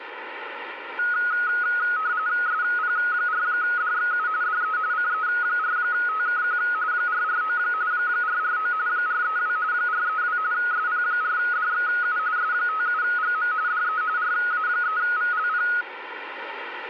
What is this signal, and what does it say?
RTTY (45.45 baud, 170 Hz shift), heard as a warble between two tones, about 1360 Hz centre, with radio static. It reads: SP4DXU DE CE4TKQ 449 449 432 432 SP4DXU S57GM DE RA3VLP